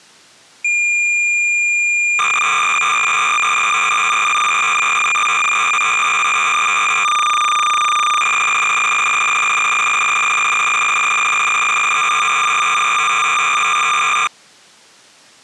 Cassette data (Kansas City type), 300 baud, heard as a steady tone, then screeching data.